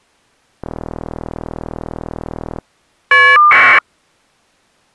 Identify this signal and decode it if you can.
Caller ID data burst, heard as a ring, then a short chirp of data, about 1200 baud.